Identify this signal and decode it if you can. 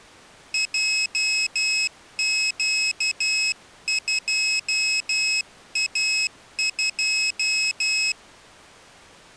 Morse code, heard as a high beeper, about 12 wpm, 2550 Hz. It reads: JQ2A2